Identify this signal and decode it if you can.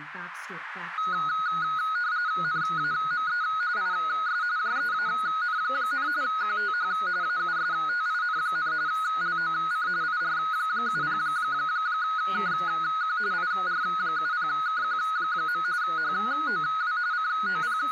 RTTY (45.45 baud, 170 Hz shift), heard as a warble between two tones, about 1360 Hz centre, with radio static and speech in English. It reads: NAME IS JEAN, QTH AUSTIN, LOC IR70KQ IR70KQ. HOW …